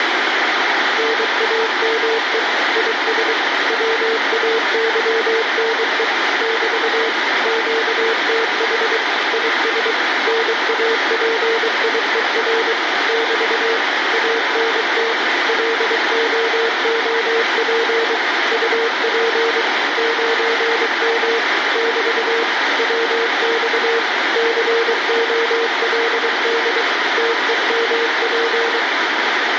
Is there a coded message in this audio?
Yes: Morse code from 0.9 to 28.9 s, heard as a keyed tone, machine-sent, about 23 wpm, 460 Hz, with heavy radio static. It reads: NAME IS WAYNE <BT> QTH IS NAPIER <BT> ANT LOOP UP 9M <BT> WX COLD TEMP